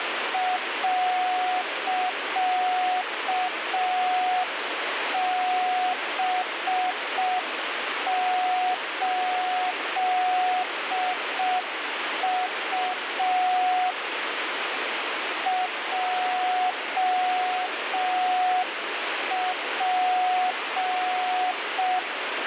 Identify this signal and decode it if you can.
Morse code, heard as a keyed tone, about 5 wpm, 730 Hz, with radio static. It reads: .B8U JP